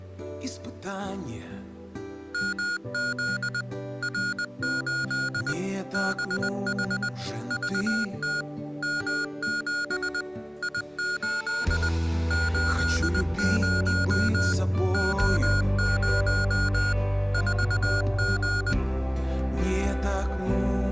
Morse code, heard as electronic beeps, machine-sent, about 20 wpm, 1440 Hz. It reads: MZ R8 BH VT M7 I8 80 O0 4G